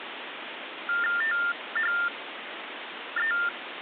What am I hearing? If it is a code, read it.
TTY/TDD text telephone tones (45.45 baud Baudot), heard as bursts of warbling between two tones, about 400 Hz shift, 1600 Hz centre, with phone line noise. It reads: THE